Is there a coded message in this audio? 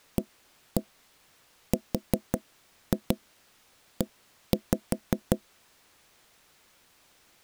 Yes: tap code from 0.2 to 5.4 s, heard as knocks on wood, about 5 knocks a second. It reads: ARE